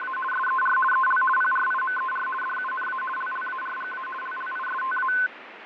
RTTY (50 baud, 450 Hz shift), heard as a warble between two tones, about 1280 Hz centre, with radio static and fading. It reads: … SER EL PRIMER DUNA LLARGA LLISTA